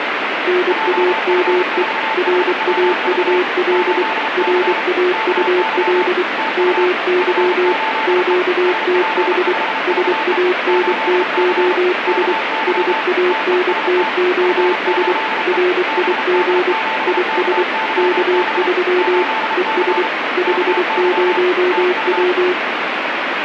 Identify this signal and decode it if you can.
Morse code, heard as two keyed tones, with radio static. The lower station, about 24 wpm, 360 Hz: NAME RAUL RAUL MY QTH SANTOS SANTOS RIG IS K3 ES 50W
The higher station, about 33 wpm, 880 Hz: JF4HWV 8C KY TU F8E SP5VE 8C KY TEST F8E BD7KYB 8C KY TU